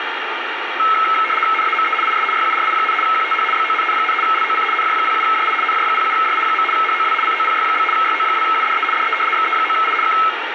RTTY (75 baud, 850 Hz shift), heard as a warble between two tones, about 1750 Hz centre, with radio static. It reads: NAME IS YURI, QTH BONN, LOC NJ07JI NJ07JI. HOW COPY? YO2UDE DE XE9I K